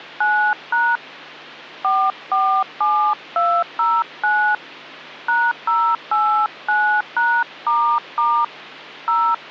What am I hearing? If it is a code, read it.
DTMF, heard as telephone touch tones, dialled by hand, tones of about 290 ms, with hum. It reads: 9# 447209 #089#** 0